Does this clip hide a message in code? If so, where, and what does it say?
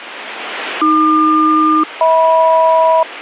Yes: aircraft SELCAL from 0.8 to 3.0 s, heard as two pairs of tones, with radio static. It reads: AQ-HM